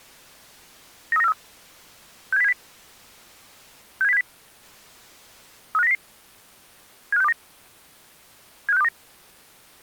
Five-tone selective call (EEA), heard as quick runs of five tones, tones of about 40 ms. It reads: 93943 67070 67070 35900 75629 75629